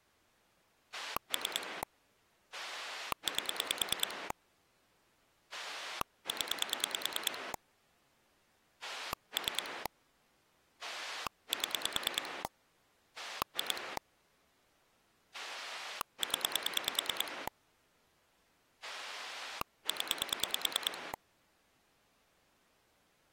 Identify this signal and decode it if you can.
Pulse dialling, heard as a rotary dial, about 9 pulses a second. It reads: 3 8 0 3 7 2 0 0